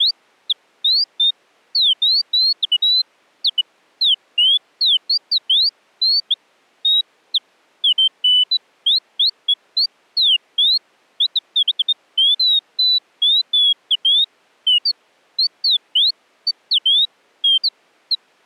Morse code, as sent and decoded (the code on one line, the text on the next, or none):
none